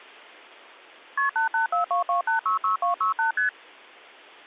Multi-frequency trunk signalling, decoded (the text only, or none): KP 88422866268 ST